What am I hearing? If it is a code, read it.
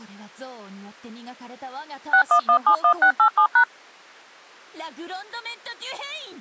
DTMF, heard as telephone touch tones, dialled by machine, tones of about 90 ms. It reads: 61171687#